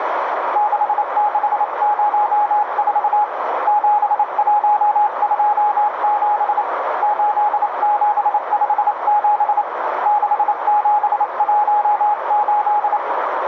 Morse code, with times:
0.6-3.2 6604
3.7-6.6 7127
7.0-9.6 8757
10.1-13.0 6718

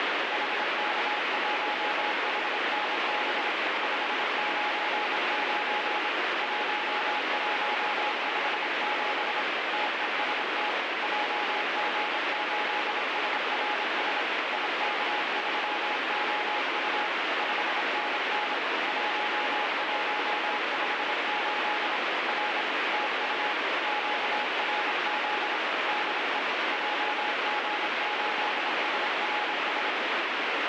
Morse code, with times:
0.3-3.5 HK1HNB
3.8-6.1 599
6.4-9.4 1157
9.7-10.7 TEST
11.0-14.2 JG8SRS
14.5-17.1 IK3OU
17.4-18.5 5NN
18.9-22.0 1158
22.3-22.6 R
22.9-23.5 TU
23.9-25.6 QRZ
25.9-26.4 DE
26.7-29.9 JG8SRS

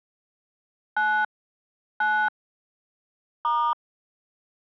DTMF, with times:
1.0-1.2 9
2.0-2.3 9
3.4-3.7 *

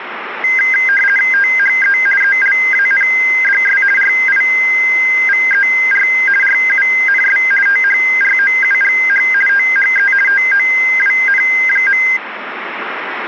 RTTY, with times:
1.3-2.0 THE
2.2-3.8 ELANDS
4.0-6.1 RIVER
6.4-7.4 RUNS
7.7-9.2 THROUGH
9.5-10.1 THE
10.3-12.0 TOWN.

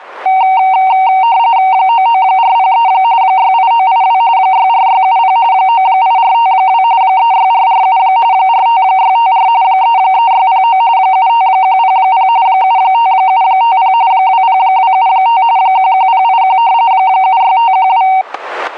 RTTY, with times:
1.7-2.9 99403
3.2-4.2 68982
4.4-5.4 64670
5.5-6.8 98452
7.0-8.0 36447
8.3-9.5 45654
9.6-10.8 33609
11.0-12.3 75100
12.5-13.9 75750
14.1-15.4 20275
15.6-16.6 11081
16.9-18.1 76512

